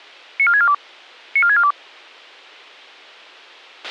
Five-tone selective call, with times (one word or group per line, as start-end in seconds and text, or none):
0.4-0.7 94642
1.4-1.7 94642